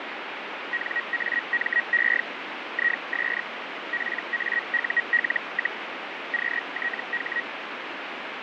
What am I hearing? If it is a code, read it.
Hellschreiber (Feld-Hell, 122.5 baud), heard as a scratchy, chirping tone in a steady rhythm, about 1900 Hz, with radio static. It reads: NAME IS PAUL, QTH